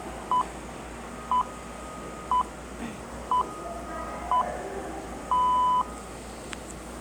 Radio time signal (six pips, as the Greenwich Time Signal), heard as pips, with room echo and the noise of a subway station.